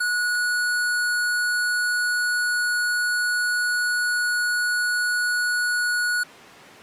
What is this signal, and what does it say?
A steady tone. There is no code.